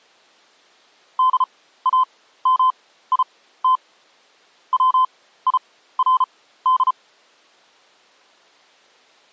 Morse code, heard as a keyed tone, machine-sent, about 34 wpm, spaced as for 16 wpm, 1030 Hz. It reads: DAMIT WIRD